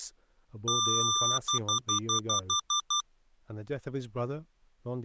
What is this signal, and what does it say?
Beep code, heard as beeps from a small speaker, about 1190 Hz, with speech in English. 1 long, 8 short. In AMI BIOS tables: display or retrace test failure.